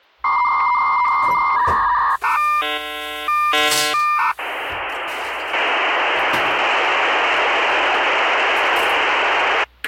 Dial-up modem handshake (V.34 or later), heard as a whistle, warbles, then hiss, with kitchen noise.